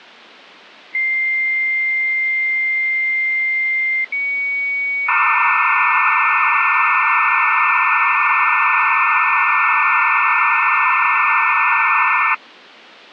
Dial-up modem handshake (low-speed, two carriers), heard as two whistles, then hiss.